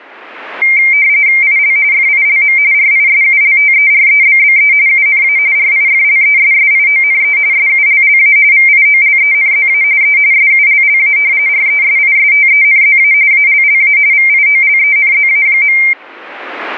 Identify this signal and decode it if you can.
RTTY (45.45 baud, 170 Hz shift), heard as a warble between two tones, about 2200 Hz centre. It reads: IL FILM RISULTEREBBE UNA RIFLESSIONE SULLA VIOLENZA E SULLA RESISTENZA ALLA VIOLENZA.